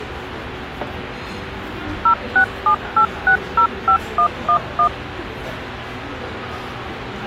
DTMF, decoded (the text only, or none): 0678605111